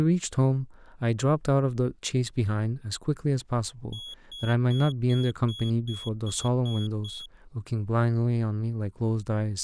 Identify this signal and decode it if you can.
Beep code, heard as a piezo beeper, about 3350 Hz, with speech in English. 9 short. In AMI BIOS tables: ROM checksum failure.